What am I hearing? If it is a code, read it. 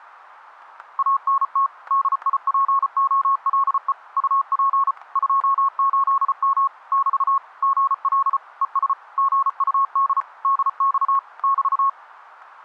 Morse code, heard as a keyed tone, machine-sent, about 34 wpm, 1100 Hz, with static crashes. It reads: ANT DIPOLE UP 28M <BT> GL ES GUD DX <BT>